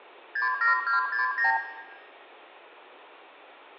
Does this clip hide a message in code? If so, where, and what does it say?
Yes: multi-frequency trunk signalling (R2, with the far end's replies) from 0.4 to 1.6 s, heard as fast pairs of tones, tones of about 130 ms, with hum and room echo. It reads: 67269